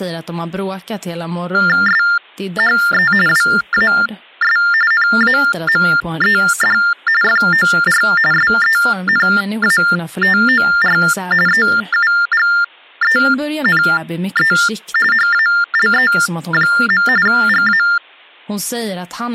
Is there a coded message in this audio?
Yes: TTY/TDD text telephone tones (45.45 baud Baudot) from 1.5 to 18.0 s, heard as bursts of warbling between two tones, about 400 Hz shift, 1600 Hz centre, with speech in Swedish. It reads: SHE WAS NAMED FOR SENATOR EUGENE HALE. GA